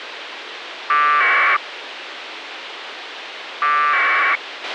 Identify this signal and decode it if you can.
Packet radio (AX.25, as in APRS), 1200 baud, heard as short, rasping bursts, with radio hiss and a squelch burst at the end.